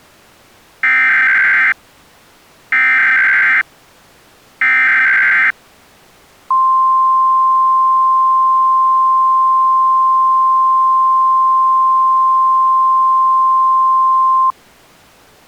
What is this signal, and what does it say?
Emergency Alert System (SAME) tones (header bursts, then the 1050 Hz attention tone), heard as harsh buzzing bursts, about 520.83 baud.